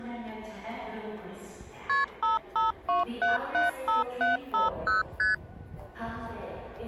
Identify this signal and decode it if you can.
Multi-frequency trunk signalling (R1, as on North American trunks), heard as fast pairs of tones, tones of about 150 ms, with the noise of a subway station. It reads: KP 552775750 ST